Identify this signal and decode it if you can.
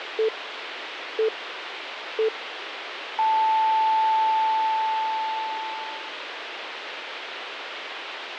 Radio time signal (three low pips and a long one an octave up, as on NHK), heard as pips, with radio hiss.